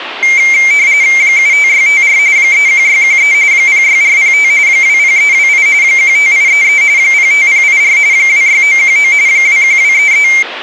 RTTY (45.45 baud, 170 Hz shift), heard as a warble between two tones, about 2200 Hz centre, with radio static. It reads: 75654 31613 06405 20328 15833 05084 26919 21233